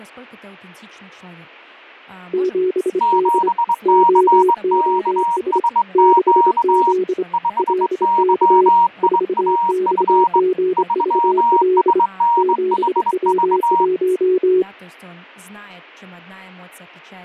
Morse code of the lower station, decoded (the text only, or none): 7D OOS 6Z LK 4XGVL 7W1